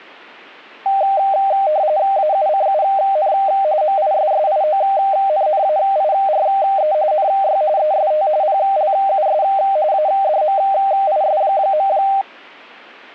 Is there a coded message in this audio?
Yes: RTTY (45.45 baud, 170 Hz shift) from 0.9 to 12.2 s, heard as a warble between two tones, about 700 Hz centre. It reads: AUCUN MISSIONNAIRE NY EST PLUS ADMIS.